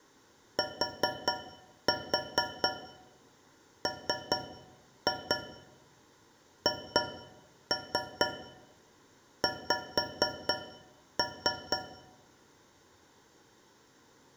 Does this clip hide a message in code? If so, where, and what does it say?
Yes: tap code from 0.6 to 11.9 s, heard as taps on a metal pipe, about 4 knocks a second, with room echo. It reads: TMHX